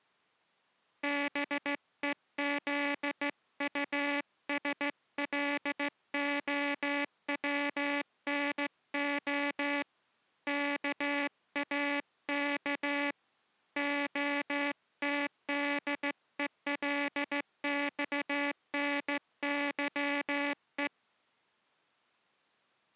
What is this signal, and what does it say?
Morse code (Russian alphabet), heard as a buzzer, hand-sent with a straight key, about 15 wpm. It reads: БЕЗУСЛОВНО КАК ОТДЕЛЬНЫЕ